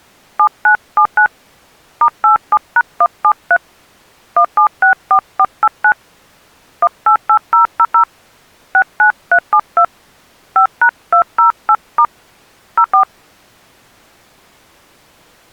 DTMF, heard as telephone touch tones, dialled by hand, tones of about 80 ms. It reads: 7979 *87#173 1764489 188000 69372 5#208* 04